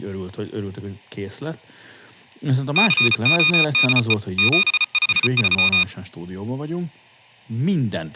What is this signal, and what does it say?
Morse code, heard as electronic beeps, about 34 wpm, 1230 Hz, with speech in Hungarian. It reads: CODE 753